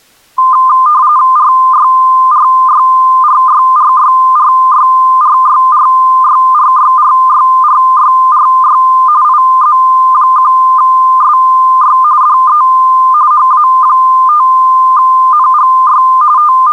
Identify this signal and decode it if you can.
RTTY (45.45 baud, 170 Hz shift), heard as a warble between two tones, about 1120 Hz centre. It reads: RYRYRYRYRYRYRYRYRYRYRY IZ1SY DE HA5NGY …